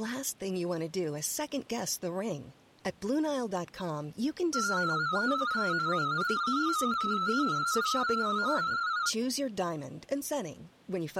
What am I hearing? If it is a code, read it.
Multi-tone FSK (Olivia or MFSK type), about 250 Hz wide, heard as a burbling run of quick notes, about 31.25 baud, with speech in English.